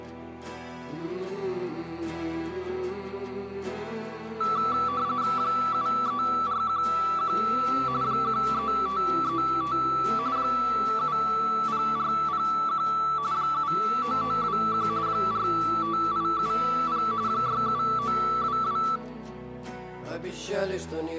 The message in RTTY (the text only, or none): 73411 13535 70401 79921 45870 67922